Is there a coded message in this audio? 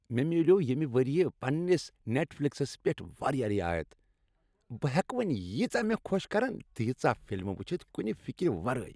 No, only speech in Kashmiri.